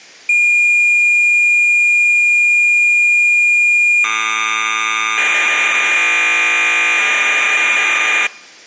Cassette data (Kansas City type), 1200 baud, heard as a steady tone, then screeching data.